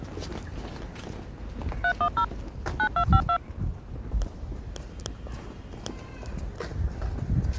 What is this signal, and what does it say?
DTMF, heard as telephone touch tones, dialled by machine, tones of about 80 ms, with street noise. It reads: 310 9252